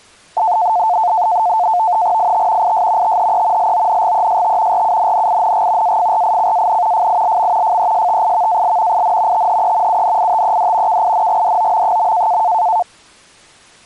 NAVTEX (SITOR-B), 100 baud, 170 Hz shift, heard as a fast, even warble, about 800 Hz centre. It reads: IT IS THE LONGEST RUNNING AFRICAN FILM FESTIVAL IN THE UNITED KINGDOM.